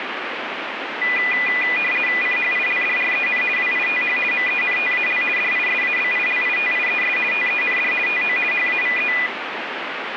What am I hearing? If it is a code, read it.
RTTY (50 baud, 450 Hz shift), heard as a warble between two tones, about 2200 Hz centre, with radio static. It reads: CHILDREN WITH MENTAL DISABILITIES TEND TO HAVE